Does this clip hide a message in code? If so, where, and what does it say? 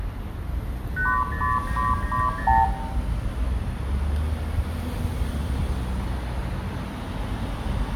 Yes: multi-frequency trunk signalling (R2, with the far end's replies) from 1.0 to 2.6 s, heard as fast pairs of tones, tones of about 180 ms, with room echo and street noise. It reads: 80990